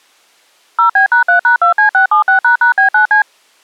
DTMF, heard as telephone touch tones, dialled by machine, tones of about 110 ms. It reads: 0B#3#2C676##B9C